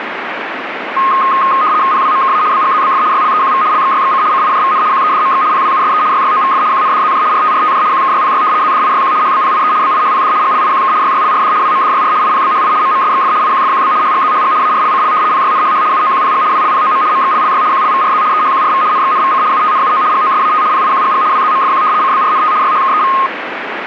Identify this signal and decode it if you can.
RTTY (75 baud, 170 Hz shift), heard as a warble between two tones, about 1160 Hz centre, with radio static. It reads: PWMKA BGZBF YLEQV LXYXC CIJVN QEDMX PWUSE YYOVF QNDZJ RTRTJ QKYPY ZDIYQ HBPIE BIHPD GLIQK YYLRD WMDYR IPBHI MMSXF IQFQB HGZHG ARLCL PYNHH UOQPG WLPOM MXLLY QLVRZ EHQRV NXNVC UTNUO GOSAT PIQGG WZMFQ CBRNT YHKEV